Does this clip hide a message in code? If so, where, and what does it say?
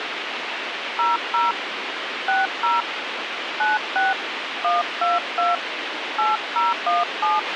Yes: DTMF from 1.0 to 7.4 s, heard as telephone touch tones, dialled by hand, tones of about 170 ms, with radio hiss and a squelch burst at the end. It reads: 00 60 96 122 8017